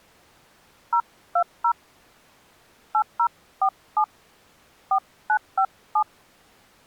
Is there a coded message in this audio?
Yes: DTMF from 0.9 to 6.0 s, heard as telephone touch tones, dialled by hand, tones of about 80 ms. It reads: 020 8047 4957